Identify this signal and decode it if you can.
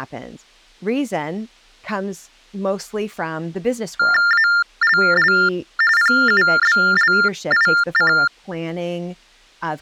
TTY/TDD text telephone tones (45.45 baud Baudot), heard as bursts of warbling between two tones, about 400 Hz shift, 1600 Hz centre, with speech in English. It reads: ALL PUBLIC